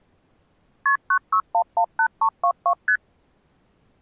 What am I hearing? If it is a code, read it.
Multi-frequency trunk signalling (R1, as on North American trunks), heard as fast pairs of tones, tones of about 80 ms. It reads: KP 96118322 ST